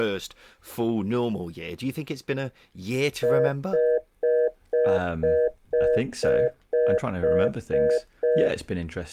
Telephone call progress tone (North American plan), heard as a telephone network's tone, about 480, 620 Hz, 0.25 s on and 0.25 s off, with speech in English. Congestion tone.